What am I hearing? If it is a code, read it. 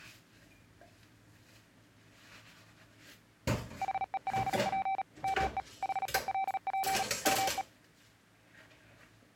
Morse code, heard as a keyed tone, machine-sent, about 37 wpm, 770 Hz, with kitchen noise. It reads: HELP ME HELP ME